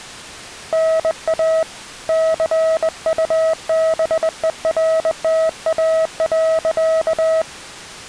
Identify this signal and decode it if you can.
Morse code, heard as a keyed tone, hand-sent with a straight key, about 21 wpm, 640 Hz. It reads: NA CUBERTA.